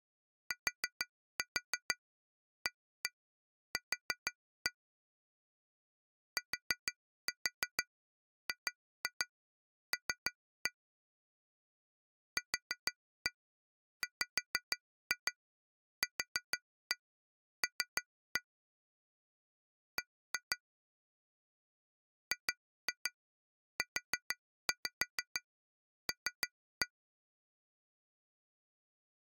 Tap code, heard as taps on glass, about 6 knocks a second. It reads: TAQ TGL QWQL B GUL